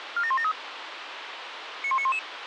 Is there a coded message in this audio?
Yes: five-tone selective call (ZVEI) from 0.2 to 2.2 s, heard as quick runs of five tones, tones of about 70 ms, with radio hiss. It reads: 47173 91911